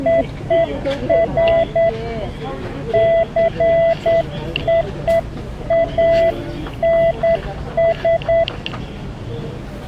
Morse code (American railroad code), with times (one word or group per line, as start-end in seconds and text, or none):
0.1-1.9 OF
2.9-8.4 JOANS